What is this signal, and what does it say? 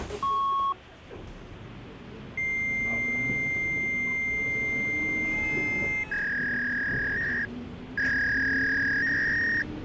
Fax machine handshake, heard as a beep, a long tone and a warble, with the noise inside a bus.